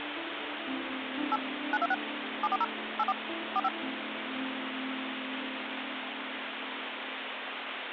DTMF, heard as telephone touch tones, dialled by machine, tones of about 40 ms, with phone line noise. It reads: 8 926 740 84 45